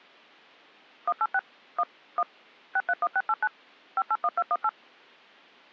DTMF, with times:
1.1-1.4 186
1.8-1.8 1
2.2-2.2 1
2.8-3.5 631689
4.0-4.7 581218

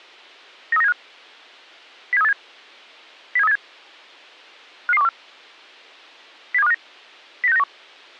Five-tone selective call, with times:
0.7-0.9 93975
2.1-2.3 07387
3.4-3.6 07387
4.9-5.1 55214
6.5-6.7 07259
7.4-7.6 09691

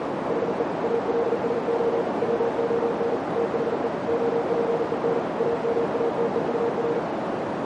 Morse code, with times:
0.3-0.6 HE
0.8-2.0 ALSO
2.2-3.2 WON
3.4-3.9 THE
4.1-5.2 OPEN
5.4-7.0 AMATEUR

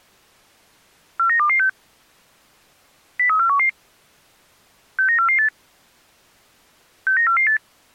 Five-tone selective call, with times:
1.2-1.7 49226
3.2-3.7 03411
5.0-5.5 69448
7.1-7.6 69448

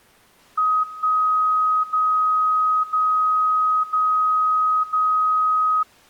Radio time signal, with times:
0.8-1.8 1
1.8-2.8 0
2.8-3.8 0
3.8-4.8 0
4.8-5.8 0

